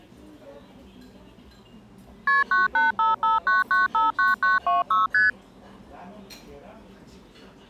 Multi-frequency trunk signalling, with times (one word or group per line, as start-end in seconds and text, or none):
2.3-2.4 KP
2.5-5.1 98559959926
5.1-5.3 ST